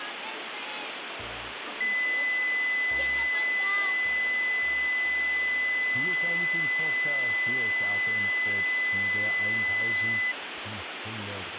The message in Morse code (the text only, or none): none